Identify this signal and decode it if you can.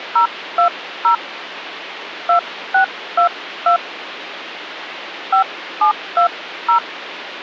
DTMF, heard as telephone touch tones, dialled by hand, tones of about 100 ms, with phone line noise. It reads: 020 2622 5720